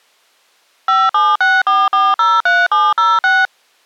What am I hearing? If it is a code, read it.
DTMF, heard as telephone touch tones, dialled by machine, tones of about 210 ms. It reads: 5764403706